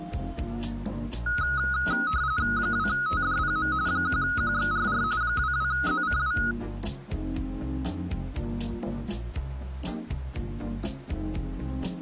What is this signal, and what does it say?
RTTY (45.45 baud, 170 Hz shift), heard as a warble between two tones, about 1360 Hz centre. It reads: 2TDPM 1QXRR 22ZCW